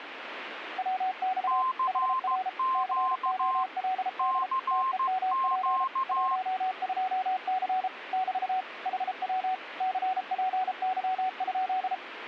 Morse code, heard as two keyed tones, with radio static. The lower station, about 33 wpm, 750 Hz: WX HR COLD TEMP 12C <BT> HW CPY?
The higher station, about 15 wpm, 1050 Hz: CQ CQ